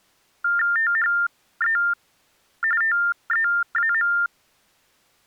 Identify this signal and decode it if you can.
TTY/TDD text telephone tones (45.45 baud Baudot), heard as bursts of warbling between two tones, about 400 Hz shift, 1600 Hz centre. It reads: THE TEAM